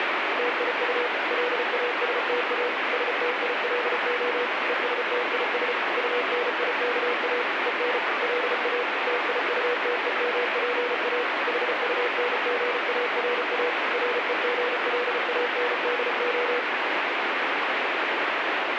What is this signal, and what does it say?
Morse code, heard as a keyed tone, machine-sent, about 34 wpm, 490 Hz, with heavy radio static. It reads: TIU LASTA STILO ESTIS UNIKA EN LA TIUTEMPA HUNGARA REGLANDO